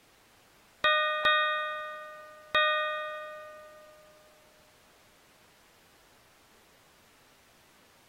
Ship's bell, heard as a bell. 3. Three half-hours of the watch have passed.